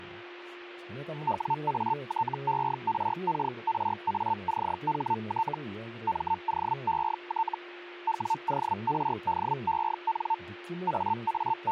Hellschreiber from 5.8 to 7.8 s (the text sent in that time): MOET